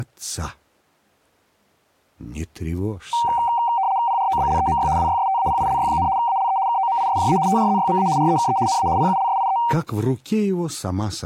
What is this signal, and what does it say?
RTTY (75 baud, 170 Hz shift), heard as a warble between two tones, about 860 Hz centre. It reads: PROBLEMY WYSTAPILY, ALE KOMISJA TRZYMA REKE NA PULSIE